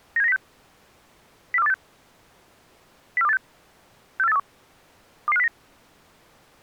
Five-tone selective call (EEA), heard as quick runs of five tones, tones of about 40 ms. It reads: 97906 04286 04286 64831 22509